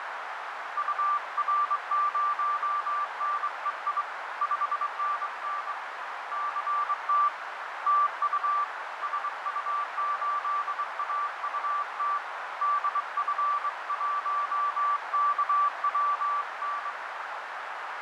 Morse code, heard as a keyed tone, hand-sent with a straight key, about 23 wpm, 1170 Hz, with heavy radio static, fading and a narrow filter. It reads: UR0NEI 5NN CT TU SU8AUT DF1KWN